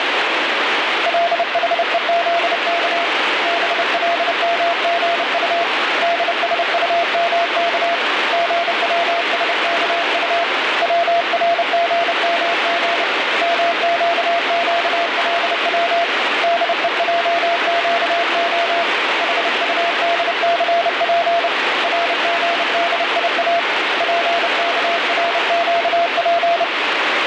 Morse code (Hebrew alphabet), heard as a keyed tone, hand-sent with a paddle, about 30 wpm, 680 Hz, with heavy radio static. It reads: לחוזך בלמגט דשטמך גצשכט צרגמג מקקלץ דועקה חטדסף רגדיא פכרקף